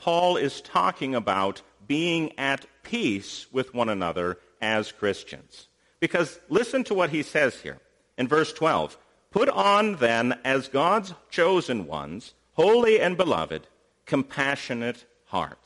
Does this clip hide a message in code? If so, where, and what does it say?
No.